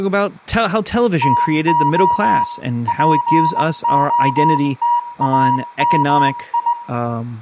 Morse code (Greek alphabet), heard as a keyed tone, hand-sent with a straight key, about 20 wpm, 960 Hz, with room echo and speech in English. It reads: ΤΟ ΠΟΤΑΜΙ